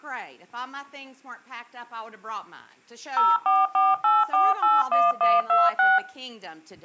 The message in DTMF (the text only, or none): 0448481126